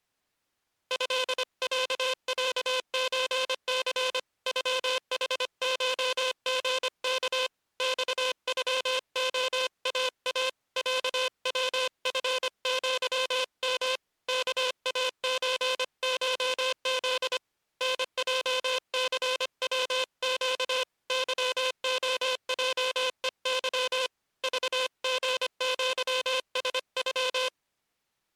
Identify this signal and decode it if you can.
Morse code (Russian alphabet), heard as a buzzer, hand-sent with a paddle, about 25 wpm. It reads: ЭЯЯЧЦ ЮХШГК ЬЮОАА ЯВФЪМ КАЧШЗ НЙЦВЩ ЫОЙЕЫ ЖГЪСЮ